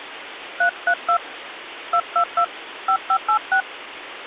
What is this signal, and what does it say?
DTMF, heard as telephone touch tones, dialled by hand, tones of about 80 ms, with phone line noise. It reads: 332 222 5586